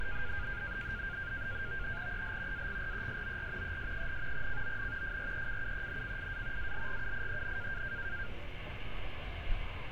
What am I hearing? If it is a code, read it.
NAVTEX (SITOR-B), 100 baud, 170 Hz shift, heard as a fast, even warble, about 1500 Hz centre, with radio static and street noise. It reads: EL AGRESOR ES, CON FRECUENCIA ALGUIEN